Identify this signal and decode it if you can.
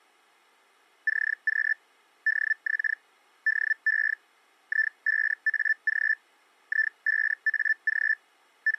Hellschreiber (Feld-Hell, 122.5 baud), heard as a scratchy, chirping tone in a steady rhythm, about 1750 Hz. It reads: CQ DX DE I5AG I5AG …